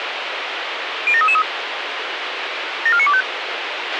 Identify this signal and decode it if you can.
Five-tone selective call (ZVEI), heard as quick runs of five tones, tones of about 70 ms, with radio hiss and a squelch burst at the end. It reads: 07333 74925